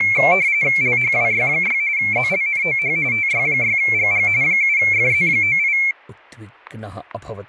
RTTY (45.45 baud, 170 Hz shift), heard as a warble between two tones, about 2250 Hz centre, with static crashes and speech in Sanskrit. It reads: LHWY6 ZLNOH TY6GG 7FZ98